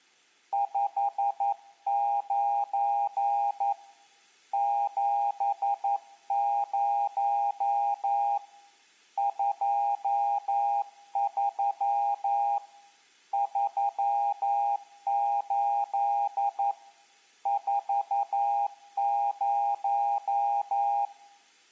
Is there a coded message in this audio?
Yes: Morse code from 0.5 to 21.1 s, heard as a keyed tone, hand-sent with a paddle, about 11 wpm, 810 Hz, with room echo. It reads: 59 70 23 38 40